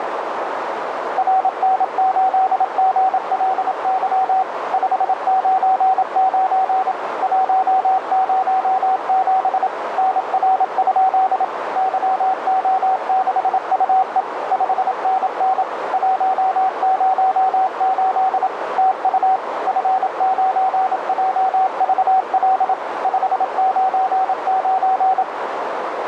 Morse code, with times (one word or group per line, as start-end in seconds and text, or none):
1.2-4.4 RN8GLY
4.7-6.9 599
7.2-9.7 107
10.0-11.4 NR?
11.8-14.2 YO6UE
14.5-15.6 5NN
15.9-18.5 108
18.8-19.4 TU
19.7-22.7 F9JVL
23.0-25.2 599